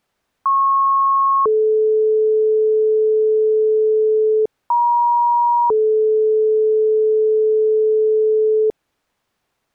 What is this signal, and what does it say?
Two-tone page, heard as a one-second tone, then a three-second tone, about 1090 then 430 Hz, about 950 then 430 Hz.